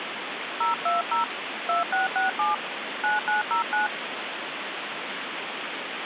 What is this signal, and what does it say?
DTMF, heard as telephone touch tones, dialled by hand, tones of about 130 ms, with phone line noise. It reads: 020 2667 9909